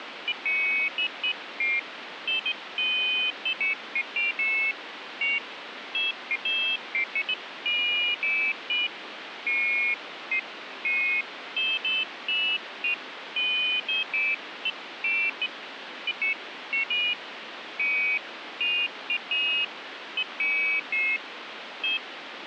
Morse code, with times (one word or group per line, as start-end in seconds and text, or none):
none